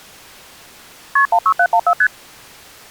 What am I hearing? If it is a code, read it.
Multi-frequency trunk signalling (R1, as on North American trunks), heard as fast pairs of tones, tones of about 70 ms. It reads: KP 16714 ST